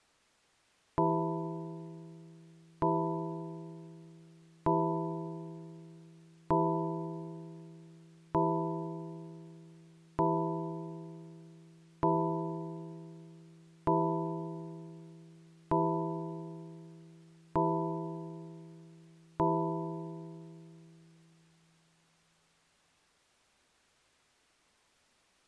Clock strike, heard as a bell. 11. Eleven o'clock.